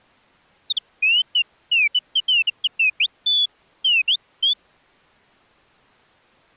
Bird-like chirps. There is no code.